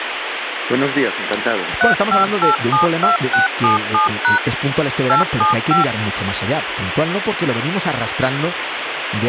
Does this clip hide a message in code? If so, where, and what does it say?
Yes: DTMF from 1.8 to 5.8 s, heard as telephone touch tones, dialled by machine, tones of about 130 ms, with phone line noise. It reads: 35872677# 875